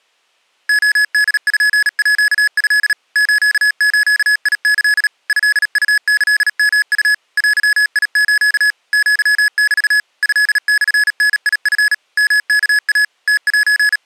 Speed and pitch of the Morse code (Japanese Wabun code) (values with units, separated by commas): 37 wpm, 1700 Hz